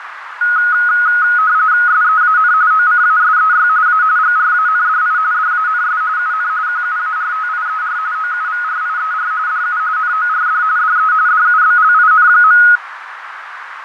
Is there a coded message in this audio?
Yes: RTTY (45.45 baud, 170 Hz shift) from 0.4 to 12.8 s, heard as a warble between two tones, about 1360 Hz centre, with radio static, fading and a narrow filter. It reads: SEAN OCASEY A GRANDI DANS UN QUARTIER OUVRIER DU NORD DE DUBLIN.